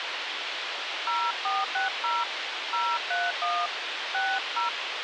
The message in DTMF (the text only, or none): 0460 031 60